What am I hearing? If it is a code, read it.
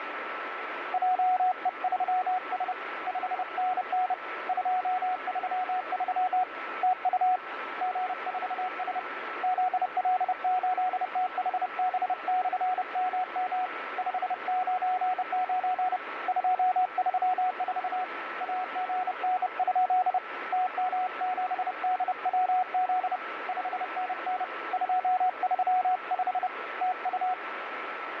Morse code, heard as a keyed tone, hand-sent with a bug key, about 30 wpm, 740 Hz, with radio static and a steady whistle near 1320 Hz. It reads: JE3S 5NN 233 TU G4S ZL8THB/MM 599 234 AGN? TM7DWZ 5NN 235 TU